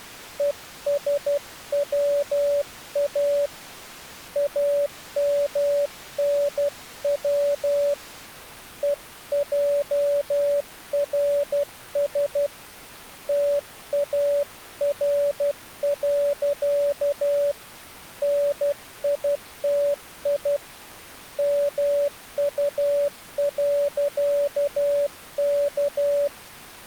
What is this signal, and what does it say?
Morse code, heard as a keyed tone, hand-sent with a paddle, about 12 wpm, 570 Hz. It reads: ESWA AMNW EJRS TAR. NITI MU.K